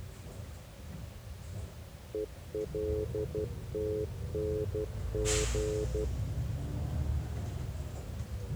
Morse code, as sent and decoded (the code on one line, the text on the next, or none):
. .-.. - -. --.
ELTNG